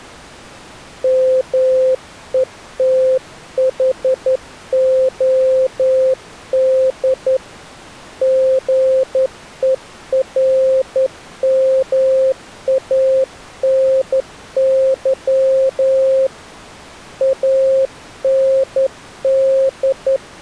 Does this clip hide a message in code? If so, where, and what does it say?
Yes: Morse code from 1.0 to 20.2 s, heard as a keyed tone, hand-sent with a straight key, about 11 wpm, 530 Hz. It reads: METHOD GERMANY AND